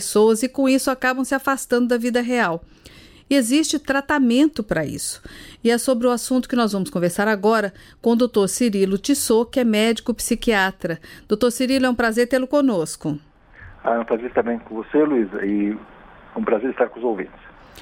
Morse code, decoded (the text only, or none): none